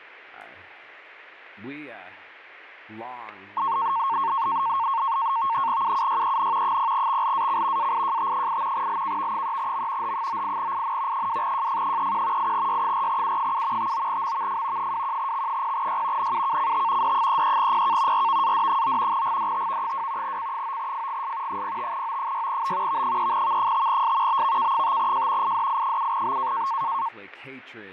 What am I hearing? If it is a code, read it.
NAVTEX (SITOR-B), 100 baud, 170 Hz shift, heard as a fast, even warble, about 1000 Hz centre, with fading. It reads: UUYEN 0XLAC AIJT8 LKV3M H98IN 2JF31 8Y4U7 59MVF 21X0Y NUKCT D33PK RVAD9 GDTV2 C9FGS 05O6B V3V5S BVK5J IDI7B